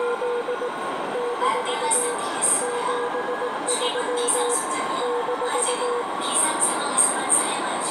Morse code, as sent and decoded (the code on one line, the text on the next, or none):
… / -....- / --... ...-- / -....-
… - 73 -